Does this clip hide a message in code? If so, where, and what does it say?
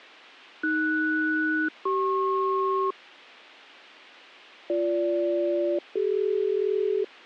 Yes: aircraft SELCAL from 0.6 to 7.0 s, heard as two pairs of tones. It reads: AS-CP BG-CD